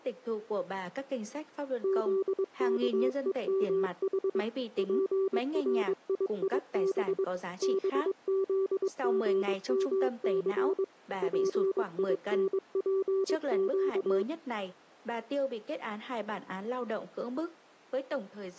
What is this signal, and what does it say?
Morse code, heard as a keyed tone, machine-sent, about 22 wpm, 380 Hz. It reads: ZKEMH PRIIB BZGMC PINPQ